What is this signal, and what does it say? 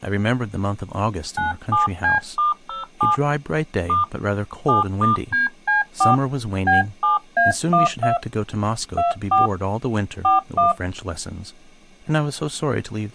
DTMF, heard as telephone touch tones, dialled by hand, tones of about 150 ms, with speech in English. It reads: 97C*07 * 7*DC4 B7A12 24 41